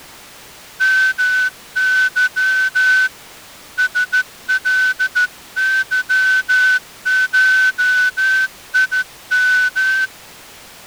Morse code (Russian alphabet), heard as a whistle, hand-sent with a straight key, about 14 wpm. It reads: МЫ СЛЫШИМ